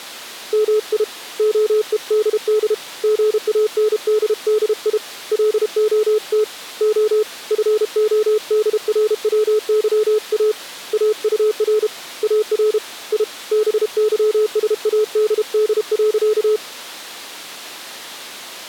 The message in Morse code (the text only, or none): MI OEDD GANDDI LOT O FODRWYA AUR AR I BYSADD.